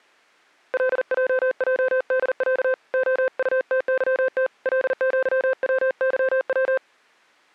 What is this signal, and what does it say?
Morse code (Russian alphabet), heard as a keyed tone, hand-sent with a paddle, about 40 wpm, 520 Hz. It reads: ЛЙЙДЯ ОУТЫТ ЛЪВЫВ